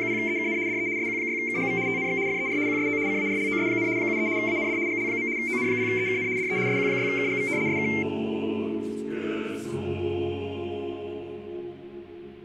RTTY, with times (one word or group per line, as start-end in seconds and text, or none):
0.0-0.6 …
0.7-0.9 DE
1.0-1.8 SQ6KGV
1.9-2.2 TNX
2.3-2.6 FER
2.7-3.0 QSO
3.1-3.9 CARLOS,
4.0-4.3 73
4.4-4.8 AND
4.9-5.3 GL.
5.4-6.3 ON0EKN
6.4-6.6 DE
6.7-7.5 SQ6KGV
7.7-7.9 SK